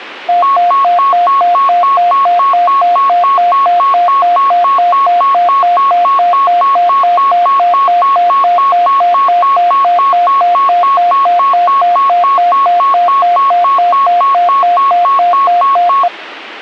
A tone that alternates evenly between two pitches. There is no code.